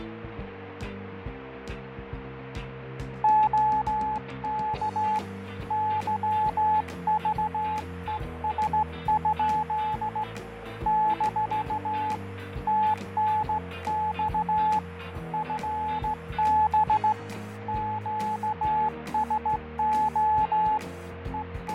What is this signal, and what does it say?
Morse code, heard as a keyed tone, hand-sent with a straight key, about 16 wpm, 860 Hz, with radio static, fading and a steady whistle near 470 Hz. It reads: OK YVES? - TNX FB QSO …